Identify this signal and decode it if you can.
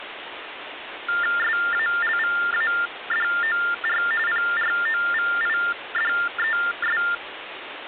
TTY/TDD text telephone tones (45.45 baud Baudot), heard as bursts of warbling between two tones, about 400 Hz shift, 1600 Hz centre, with phone line noise. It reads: SALVADOR PROVIDES